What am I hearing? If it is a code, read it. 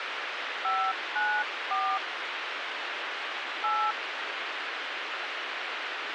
DTMF, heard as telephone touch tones, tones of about 270 ms, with radio hiss. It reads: 594 8